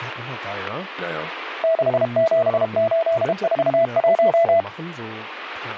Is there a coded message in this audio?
Yes: Morse code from 1.6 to 4.7 s, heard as a keyed tone, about 32 wpm, 660 Hz, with speech in German. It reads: 67841